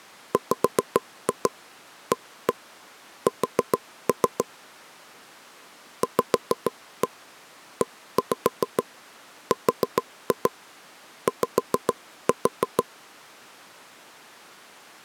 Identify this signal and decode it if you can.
Tap code, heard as taps on a table, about 6 knocks a second. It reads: WAS VERY